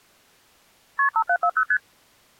Multi-frequency trunk signalling (R1, as on North American trunks), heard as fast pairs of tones, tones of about 70 ms. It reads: KP 5740 ST